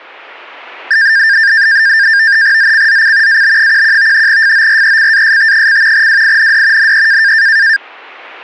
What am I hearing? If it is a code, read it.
NAVTEX (SITOR-B), 100 baud, 170 Hz shift, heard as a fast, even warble, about 1700 Hz centre. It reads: ZCZC AB11 FORECAST: WIND NE